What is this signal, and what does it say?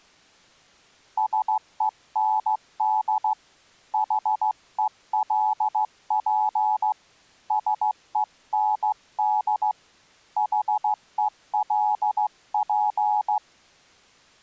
Morse code, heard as a keyed tone, hand-sent with a straight key, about 15 wpm, 850 Hz. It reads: SEND HELP SEND HELP